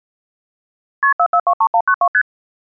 Multi-frequency trunk signalling (R1, as on North American trunks), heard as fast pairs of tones, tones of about 70 ms. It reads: KP 4423192 ST